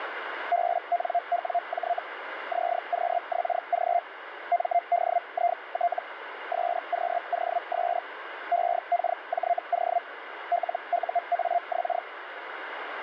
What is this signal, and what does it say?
Hellschreiber (Feld-Hell, 122.5 baud), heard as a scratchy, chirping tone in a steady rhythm, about 700 Hz, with radio static. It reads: BNWJ ZQXG MDIT SQOS EKJO LUAX